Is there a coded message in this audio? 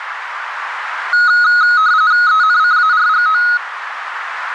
Yes: RTTY (45.45 baud, 170 Hz shift) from 1.1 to 3.6 s, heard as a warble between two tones, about 1360 Hz centre, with radio static and a narrow filter. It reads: ENCARGO